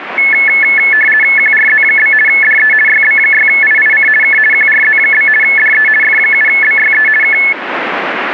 RTTY (50 baud, 450 Hz shift), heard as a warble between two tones, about 1950 Hz centre, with radio static. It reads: QRZ? DE YB6IIC K QRZ? DE F7BYE K